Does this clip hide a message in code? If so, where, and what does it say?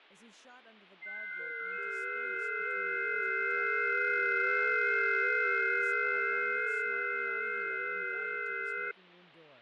Yes: FT8 (several signals at once) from 1.0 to 8.9 s, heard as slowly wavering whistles, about 6.25 baud, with radio static, fading and speech in English.